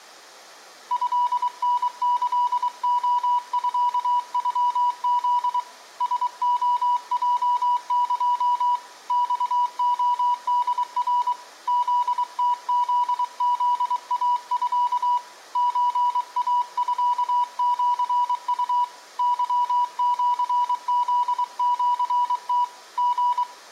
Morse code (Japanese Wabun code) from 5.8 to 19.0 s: ラレヲエ マレホナ フムフフイミ ソイミシウ

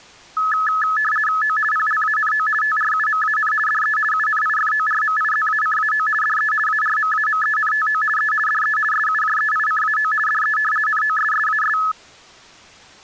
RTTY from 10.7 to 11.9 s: NOSSAS

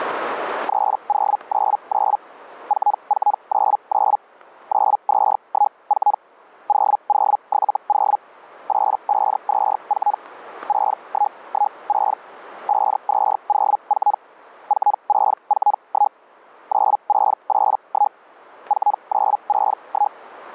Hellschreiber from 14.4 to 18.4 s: 4641 9681

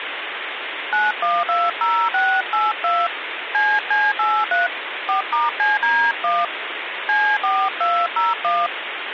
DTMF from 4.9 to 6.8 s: 4*CD1

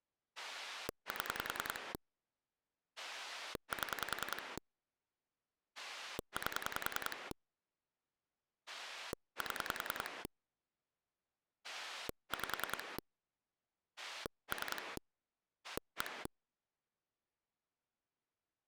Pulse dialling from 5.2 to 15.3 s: 8 7 5 3

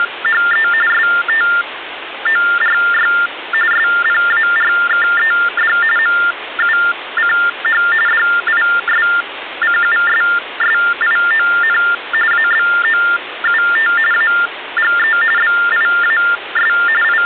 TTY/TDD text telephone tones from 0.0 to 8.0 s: … STORY SPARKED MUCH

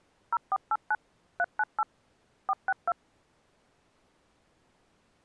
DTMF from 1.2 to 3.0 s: 398 462

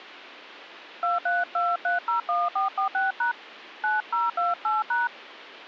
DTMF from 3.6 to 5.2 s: 9028#

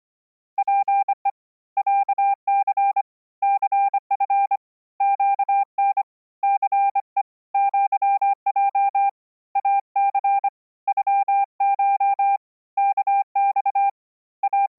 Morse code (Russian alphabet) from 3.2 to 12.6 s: ЦФ ЩН ЦЕ ЪЙ АЦ ЮШ

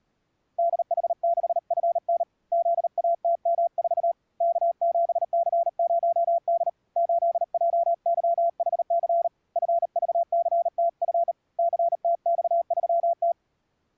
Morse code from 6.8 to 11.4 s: 8JYHC FVCTF

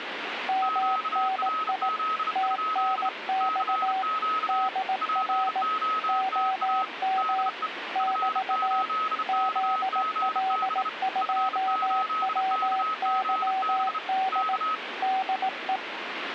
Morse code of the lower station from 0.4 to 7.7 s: MNI TNX DR OM

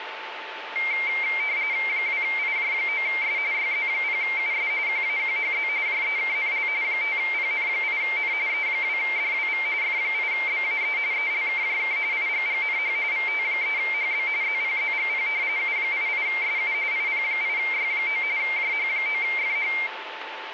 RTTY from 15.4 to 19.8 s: U88SU IP8Y9 JH9FH

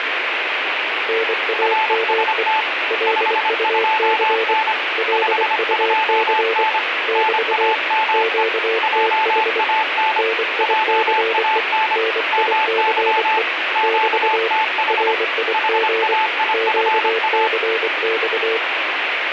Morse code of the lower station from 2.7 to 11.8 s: LUC LUC <BT> QTH NICE

